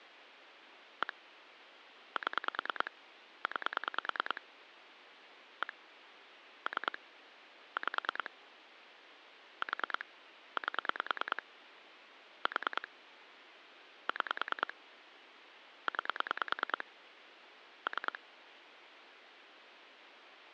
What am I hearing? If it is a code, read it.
Pulse dialling, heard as clicks on a phone line, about 9 pulses a second, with phone line noise. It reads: 1 7 9 1 3 5 4 8 4 6 9 3